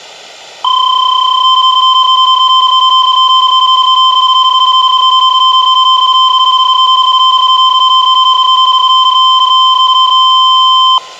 PSK31 (31.25 baud), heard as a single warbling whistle, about 1040 Hz.